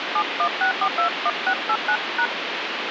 DTMF, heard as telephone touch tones, dialled by hand, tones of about 80 ms, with phone line noise. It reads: 716421689#